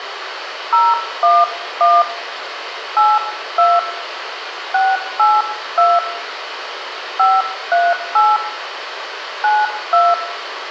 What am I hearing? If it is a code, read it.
DTMF, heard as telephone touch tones, dialled by hand, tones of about 210 ms, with radio hiss and room echo. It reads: 011 82 682 538 92